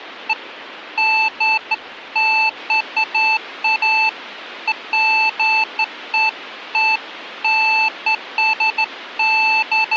Beeps of irregular length. There is no code.